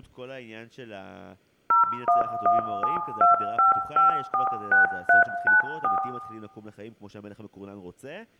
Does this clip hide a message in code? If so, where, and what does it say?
Yes: DTMF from 1.7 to 6.0 s, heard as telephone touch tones, dialled by machine, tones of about 140 ms, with room echo and speech in Hebrew. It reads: 011725546394